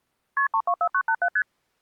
Multi-frequency trunk signalling (R1, as on North American trunks), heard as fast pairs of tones, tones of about 70 ms. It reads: KP 324987 ST